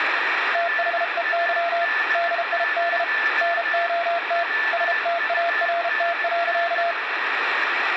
Morse code, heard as a keyed tone, hand-sent with a paddle, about 33 wpm, 680 Hz, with radio static and a weaker station near 1760 Hz. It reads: THEY DID NOT START.